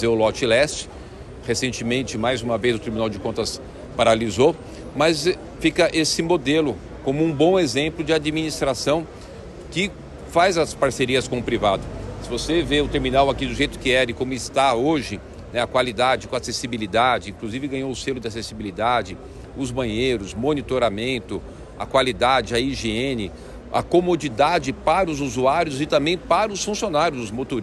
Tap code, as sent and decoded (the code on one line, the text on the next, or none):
none